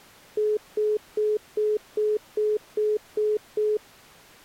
Telephone call progress tone (single-tone plan, as in most of Europe), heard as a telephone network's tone, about 420 Hz, 0.2 s on and 0.2 s off. Congestion tone.